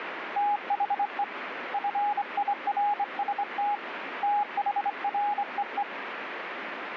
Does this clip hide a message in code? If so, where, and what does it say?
Yes: Morse code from 0.3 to 5.9 s, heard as a keyed tone, hand-sent with a straight key, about 24 wpm, 830 Hz, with radio static. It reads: THE FIRST THREE